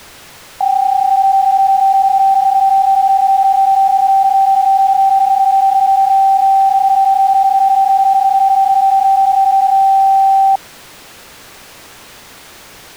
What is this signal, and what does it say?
PSK31 (31.25 baud), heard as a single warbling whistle, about 780 Hz.